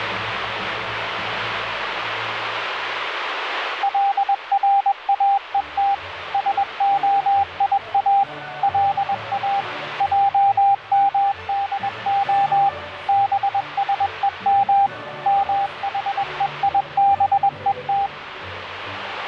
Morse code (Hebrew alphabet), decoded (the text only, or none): לראות שהיא לא עמדה בשום מחויבות